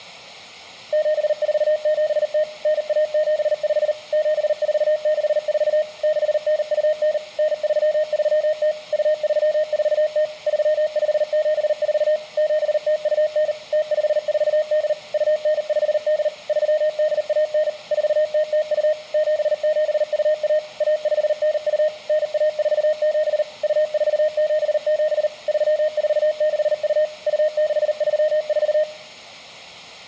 Morse code (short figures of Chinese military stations), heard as a keyed tone, machine-sent, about 39 wpm, 620 Hz, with room echo. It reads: 7470 9175 7464 6929 9330 2340 3574 7029 0548 2958 3819 4002 7721 1592 9147 2477 3462 2634